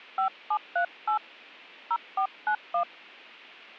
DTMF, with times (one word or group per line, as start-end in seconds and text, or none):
0.2-1.2 5738
1.9-2.8 0491